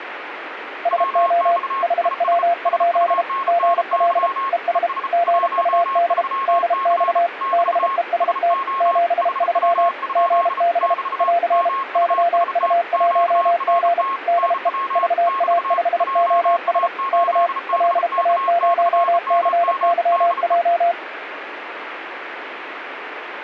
Morse code, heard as two keyed tones, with radio static. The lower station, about 32 wpm, 690 Hz: SO HW? GL ES GUD DX BEST 73 GB <AR> YU1G DE VA5OS K LA0CYJ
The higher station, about 34 wpm, 1080 Hz: WX IS SUNNY ES 13C <BT> SO HW? <BT> MUST QRT NW <BT> JA8BK/MM DE